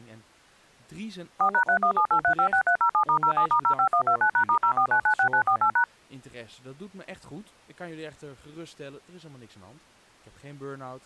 DTMF, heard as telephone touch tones, dialled by machine, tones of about 90 ms, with speech in Dutch. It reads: 4#3178356307*07*05129#*04996948#